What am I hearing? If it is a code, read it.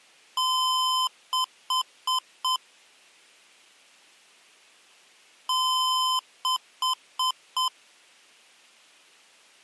Beep code, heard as beeps from a small speaker, played twice, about 1020 Hz. 1 long, 4 short.